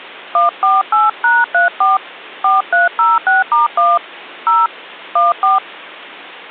DTMF, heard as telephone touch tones, dialled by hand, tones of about 170 ms. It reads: 148#34 4306*1 0 14